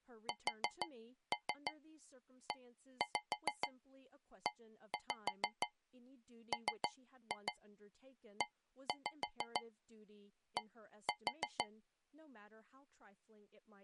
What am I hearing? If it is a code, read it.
Tap code, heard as taps on a metal pipe, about 6 knocks a second, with speech in English. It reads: SEEMED